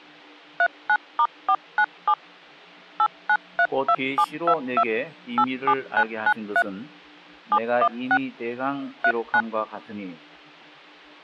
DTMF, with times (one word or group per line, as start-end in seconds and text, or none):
0.6-2.1 39*497
3.0-4.8 8932722
5.4-6.6 87993
7.5-8.2 716
9.0-9.4 39